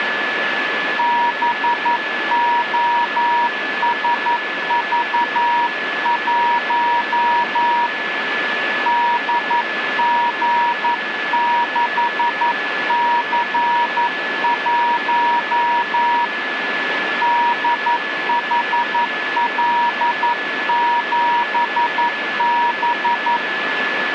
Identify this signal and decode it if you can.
Morse code, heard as a keyed tone, hand-sent with a paddle, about 11 wpm, 950 Hz, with radio static and a steady whistle near 1720 Hz. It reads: BOSV1 DG6C1 DHL7B